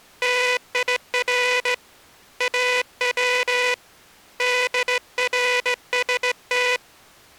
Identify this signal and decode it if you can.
Morse code (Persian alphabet), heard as a buzzer, hand-sent with a straight key, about 17 wpm. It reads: تیر او درست